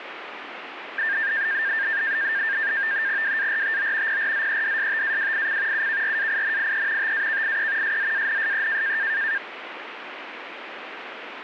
NAVTEX (SITOR-B), 100 baud, 170 Hz shift, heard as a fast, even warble, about 1700 Hz centre, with radio static. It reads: WARTO PRZEDSTAWIC UKRAINIE TAKIE SZANSE